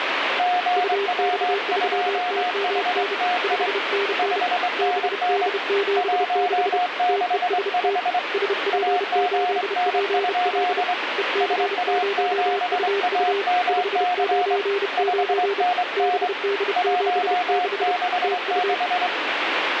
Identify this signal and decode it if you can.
Morse code, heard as two keyed tones, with radio static. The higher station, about 23 wpm, 720 Hz: GW2HTI 5NN 165 AGN? SA7AMC 5NN 166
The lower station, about 31 wpm, 400 Hz: UX3TMN 5NN BD76 TEST SP8PL EC0UU 599 BD76 TU